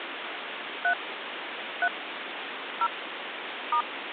DTMF, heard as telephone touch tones, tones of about 80 ms, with phone line noise. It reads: 3 3 0 *